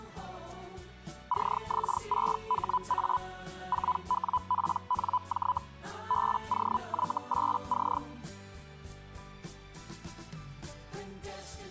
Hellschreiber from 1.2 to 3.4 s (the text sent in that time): CX6HA